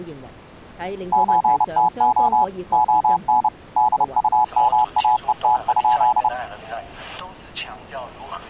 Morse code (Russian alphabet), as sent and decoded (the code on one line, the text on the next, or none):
---. - --- / --- -. / -.. ..- -- .- . - ..--..
ЧТО ОН ДУМАЕТ?